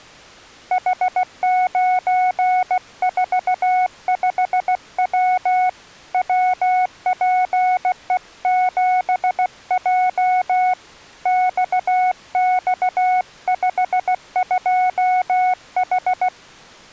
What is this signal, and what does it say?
Morse code, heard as a keyed tone, hand-sent with a paddle, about 16 wpm, 740 Hz. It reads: H945W WPE7J XX52H